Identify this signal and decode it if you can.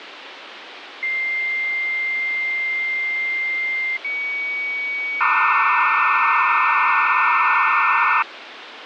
Dial-up modem handshake (low-speed, two carriers), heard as two whistles, then hiss, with phone line noise.